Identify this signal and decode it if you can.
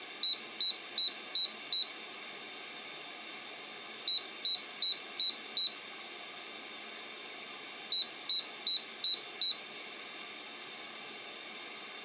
Beep code, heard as a piezo beeper, played three times, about 3900 Hz. 5 short. In AMI BIOS tables: processor failure; in Dell tables: CMOS battery failure.